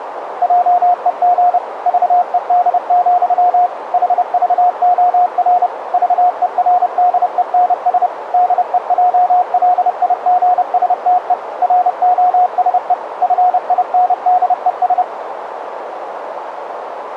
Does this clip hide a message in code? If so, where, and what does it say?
Yes: Morse code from 0.4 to 15.1 s, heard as a keyed tone, machine-sent, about 30 wpm, 720 Hz, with radio static and a narrow filter. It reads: JEG VED, HVOR VERDENS DEJLIGSTE ROSE FINDES